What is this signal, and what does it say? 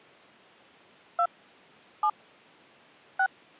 DTMF, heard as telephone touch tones, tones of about 70 ms. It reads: 2 7 6